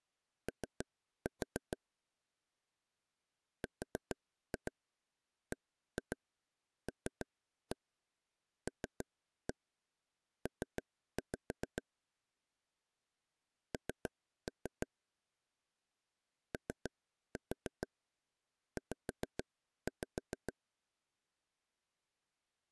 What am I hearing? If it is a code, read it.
Tap code, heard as taps on a table, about 6 knocks a second. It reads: O RBLLP N OZ